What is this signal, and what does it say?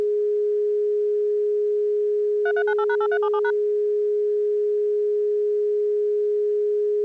DTMF, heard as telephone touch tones, dialled by machine, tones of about 60 ms. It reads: 3398#8377#